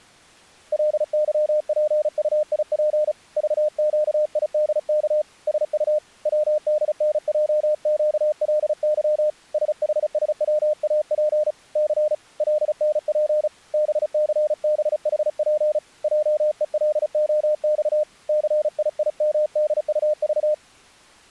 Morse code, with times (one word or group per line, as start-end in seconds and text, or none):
0.7-3.1 LYPUIP
3.4-5.2 VQIDK
5.5-6.0 SU
6.3-9.3 WDNJQLY
9.5-11.5 SHSWAP
11.8-12.1 C
12.4-13.5 LNP
13.7-15.8 BCBHP
16.0-18.0 JELOX
18.3-20.5 CIIMDUV